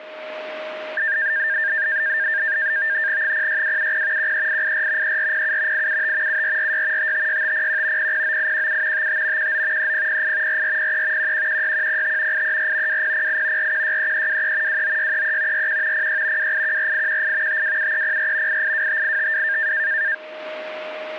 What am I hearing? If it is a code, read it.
NAVTEX (SITOR-B), 100 baud, 170 Hz shift, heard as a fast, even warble, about 1700 Hz centre, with a steady whistle near 620 Hz. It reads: 06270 13884 3407 875 7446 556501 009817 55 19 3008 4403 1116105 834 2008 4163323 29633 41 06 2814818 527304 8825852